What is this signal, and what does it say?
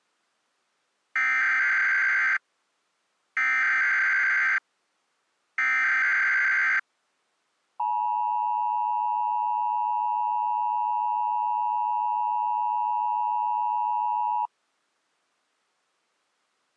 Emergency Alert System (SAME) tones (header bursts, then the 853 and 960 Hz attention tone), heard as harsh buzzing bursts, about 520.83 baud.